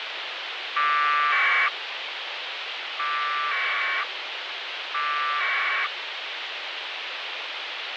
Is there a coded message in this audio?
Yes: packet radio (AX.25, as in APRS), 1200 baud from 0.8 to 5.9 s, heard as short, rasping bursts, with radio hiss.